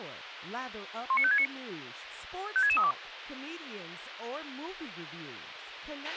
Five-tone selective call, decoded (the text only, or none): 19569 56632